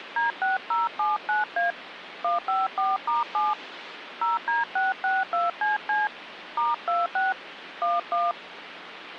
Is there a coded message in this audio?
Yes: DTMF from 0.2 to 8.3 s, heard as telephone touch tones, dialled by hand, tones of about 170 ms, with phone line noise. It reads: D6079A 154*7 0D662CC *26 11